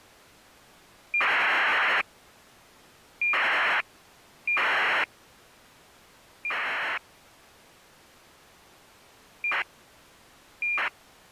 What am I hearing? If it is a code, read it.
ACARS aircraft data, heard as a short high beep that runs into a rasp, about 2400 baud.